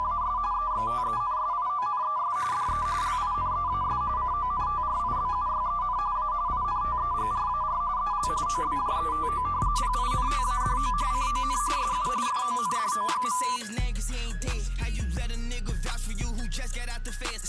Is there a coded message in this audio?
Yes: RTTY (45.45 baud, 170 Hz shift) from 0.0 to 13.6 s, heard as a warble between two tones, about 1090 Hz centre. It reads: … EXTENSIONES DE LINEAS CONTRIBUYEN A INTEGRAR EL OBJETO PINTADO CON SU FONDO.